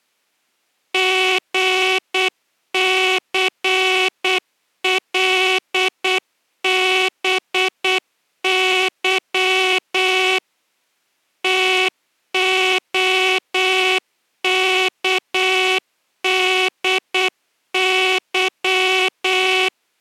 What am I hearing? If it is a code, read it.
Morse code (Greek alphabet), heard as a buzzer, machine-sent, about 8 wpm. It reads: ΓΘΛΒΥ ΤΟΚΔΥ